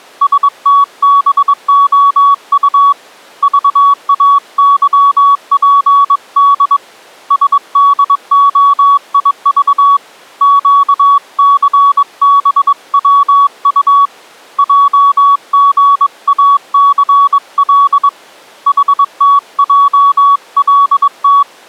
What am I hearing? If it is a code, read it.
Morse code, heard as a keyed tone, hand-sent with a paddle, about 22 wpm, 1130 Hz. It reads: STBOU VAYPD SDOIV QCBWU JGACL HTJLT